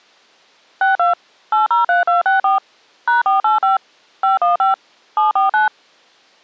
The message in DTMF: 62 803264 #485 515 749

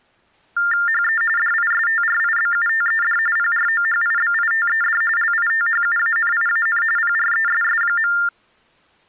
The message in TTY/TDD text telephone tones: HE DISTRIBUTED PROHIBITED LITHUANIAN PRESS.

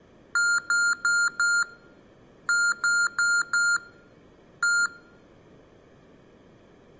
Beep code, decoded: 4-4-1

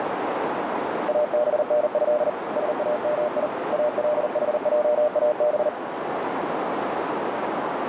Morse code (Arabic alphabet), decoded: ابنه سامي الحجاب

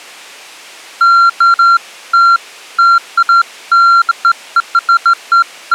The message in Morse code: none

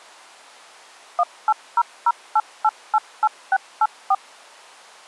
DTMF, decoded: 18008888684

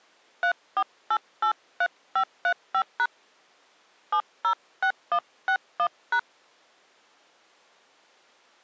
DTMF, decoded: 34883535# 706161#

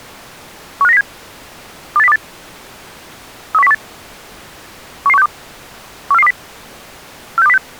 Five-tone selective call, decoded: 15907 28028 31018 11162 14420 46206

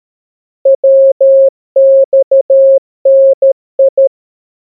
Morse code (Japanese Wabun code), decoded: ヤマダ

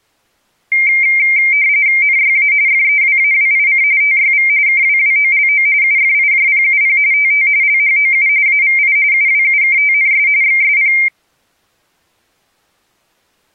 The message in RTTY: NYA FEWAWIC TYV KWWOLO UFIJPUP TT LHOU AVI UWUKTNS XSP

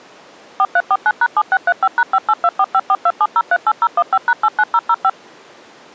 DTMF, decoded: 4349#7635#58245427038015#89005

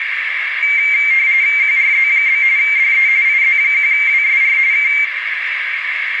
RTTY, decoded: QRZ? DE IZ1WSR K

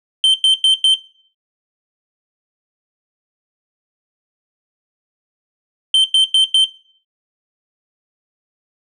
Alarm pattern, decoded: temporal four

